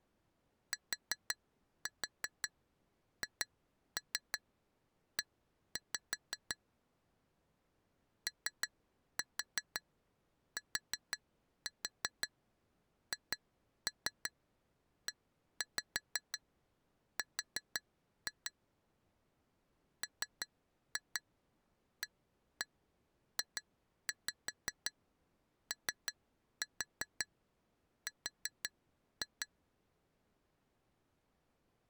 Tap code, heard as taps on glass, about 5 knocks a second. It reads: THE OTHER MAJOR